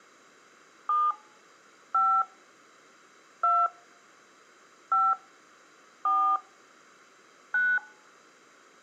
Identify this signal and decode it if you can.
DTMF, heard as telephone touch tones, dialled by hand, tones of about 240 ms. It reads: 7 5 2 5 4 9